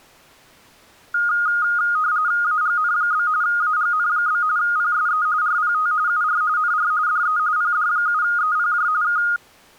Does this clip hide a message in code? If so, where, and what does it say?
Yes: RTTY (45.45 baud, 170 Hz shift) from 1.1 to 9.4 s, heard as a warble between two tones, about 1340 Hz centre. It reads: AGN? AGN? PSE RPT UR NR DE PD7EPJ K